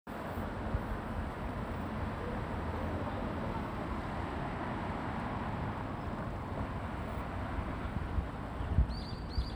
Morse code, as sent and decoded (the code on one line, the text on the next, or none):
none